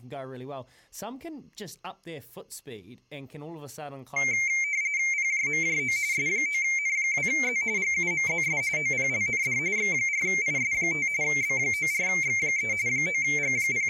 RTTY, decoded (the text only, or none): PJMJO S9N2Z GUMZS OPLND X4IS5 B94X3 …